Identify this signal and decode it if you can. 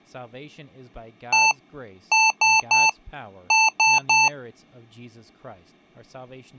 Beep code, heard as beeps from a small speaker, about 880 Hz, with speech in English. 1-3-3. In Phoenix BIOS tables: chip or data line failure in the first 64 KB of memory.